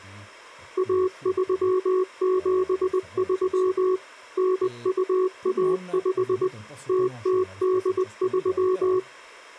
Morse code (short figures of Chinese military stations), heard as a keyed tone, machine-sent, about 20 wpm, 370 Hz, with speech in Italian. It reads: 1373 9215 0083